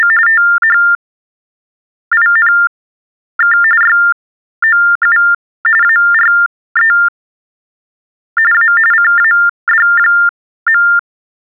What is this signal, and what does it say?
TTY/TDD text telephone tones (45.45 baud Baudot), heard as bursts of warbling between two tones, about 400 Hz shift, 1600 Hz centre. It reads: … THINK YOU ARE A CAD.